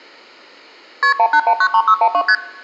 Multi-frequency trunk signalling (R1, as on North American trunks), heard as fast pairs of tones, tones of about 70 ms, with room echo. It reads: KP 18193612 ST